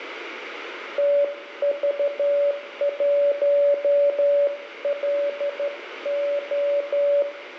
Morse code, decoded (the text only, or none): TV1LO